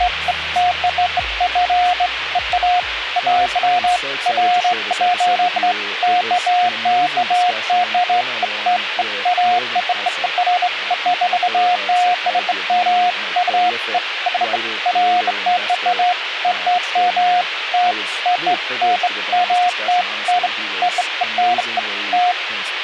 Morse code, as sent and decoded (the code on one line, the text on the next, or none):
none